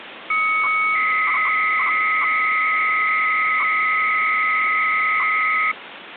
300-baud modem data (Bell 103 tones), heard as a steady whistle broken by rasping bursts, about 300 baud, 200 Hz shift, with phone line noise.